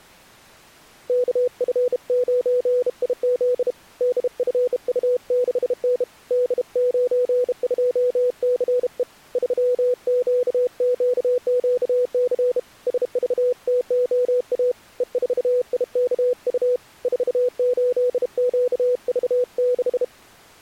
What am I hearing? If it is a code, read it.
Morse code, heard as a keyed tone, hand-sent with a bug key, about 32 wpm, 500 Hz. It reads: KF9IZ DFU6N D92CE 3QQQC SVTOA E4IKU 48QV6